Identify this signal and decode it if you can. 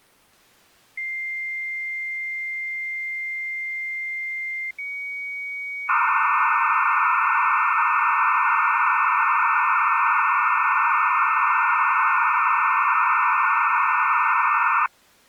Dial-up modem handshake (low-speed, two carriers), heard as two whistles, then hiss.